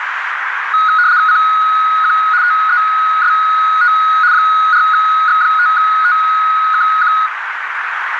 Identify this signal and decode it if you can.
RTTY (75 baud, 170 Hz shift), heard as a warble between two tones, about 1360 Hz centre, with radio static and a narrow filter. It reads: CQ TEST 4X5TKQ